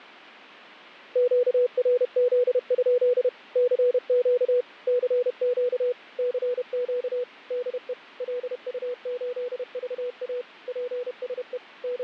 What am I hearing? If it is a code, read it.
Morse code, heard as a keyed tone, machine-sent, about 31 wpm, 490 Hz, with fading. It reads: QRZ? CQ CQ CQ DE LU8VA PSE …